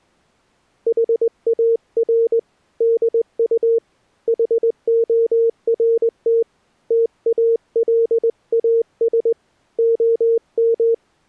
Morse code, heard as a keyed tone, hand-sent with a straight key, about 20 wpm, 460 Hz. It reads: HAR DU HORT TALAS OM